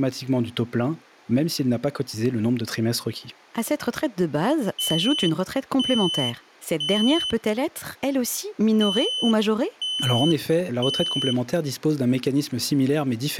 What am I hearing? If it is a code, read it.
Alarm pattern, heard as an alarm's beeps, played twice, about 3050 Hz, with speech in French. Temporal three. Smoke or fire, evacuate.